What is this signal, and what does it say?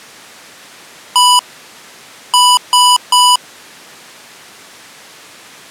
Beep code, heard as beeps from a small speaker, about 990 Hz. 1-3.